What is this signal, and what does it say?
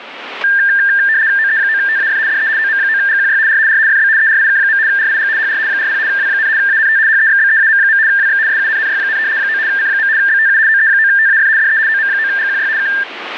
RTTY (75 baud, 170 Hz shift), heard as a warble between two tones, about 1700 Hz centre, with radio static. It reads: OE9TAF DE OM9GQY R R FB ERIK. RIG HR 40 W, ANT HEXBEAM. WX SUNNY, 9 C. BTU OE9TAF DE OM9GQY K